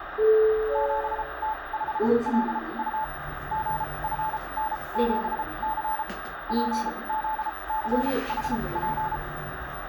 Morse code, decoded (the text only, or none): 7T5LU GFN7C PZCHP